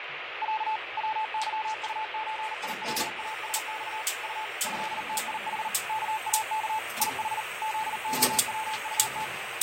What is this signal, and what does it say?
Morse code (Russian alphabet), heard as a keyed tone, machine-sent, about 39 wpm, 870 Hz, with radio static, fading and kitchen noise. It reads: Я ВЫУЧИЛАСЬ У ЭТИХ КАК ИХ ЗОВУТ